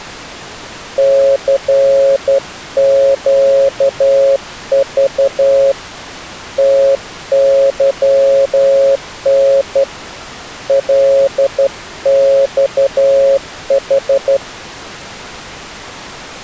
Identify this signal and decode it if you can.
Morse code, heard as a keyed tone, hand-sent with a straight key, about 12 wpm, 550 Hz. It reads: CQV TYN LXH